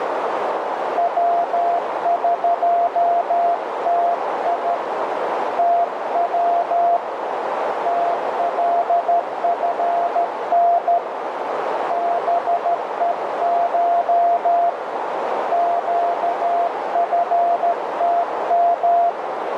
Morse code (Persian alphabet), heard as a keyed tone, hand-sent with a straight key, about 13 wpm, 690 Hz, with heavy radio static and a narrow filter. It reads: وقتی تو تلفن بهش گفتم